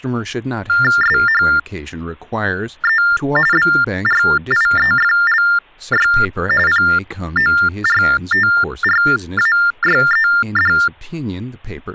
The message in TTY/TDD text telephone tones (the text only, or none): SHE BRIEFLY PORTRAYED